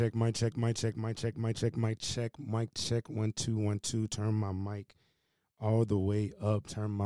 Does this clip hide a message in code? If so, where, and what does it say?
No, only speech in English.